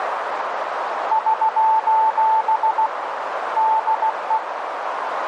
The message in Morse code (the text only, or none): <SOS> DE